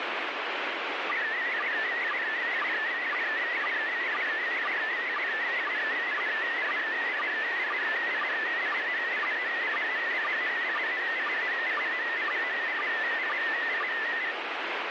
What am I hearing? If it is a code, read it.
SSTV (slow-scan television), PD 120, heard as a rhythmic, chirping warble, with heavy radio static.